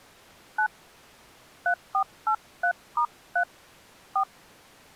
DTMF, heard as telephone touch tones, dialled by hand, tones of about 80 ms. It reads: 9 3483*3 4